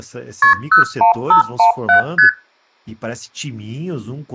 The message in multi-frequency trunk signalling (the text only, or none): KP 01517 ST